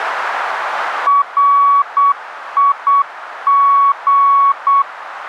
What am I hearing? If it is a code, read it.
Morse code, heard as a keyed tone, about 8 wpm, 1120 Hz, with radio static. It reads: RIG